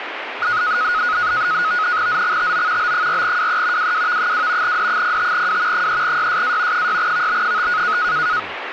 NAVTEX (SITOR-B), 100 baud, 170 Hz shift, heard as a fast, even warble, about 1360 Hz centre, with radio static and speech in Assamese. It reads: ZXTO B4WE WWV2 D05W 3YSA 6VB5